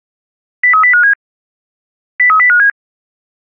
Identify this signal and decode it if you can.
Five-tone selective call (CCIR), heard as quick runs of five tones, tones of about 100 ms. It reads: 03057 03057